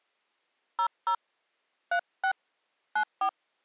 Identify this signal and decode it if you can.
DTMF, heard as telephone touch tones, dialled by hand, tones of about 80 ms. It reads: 00 36 94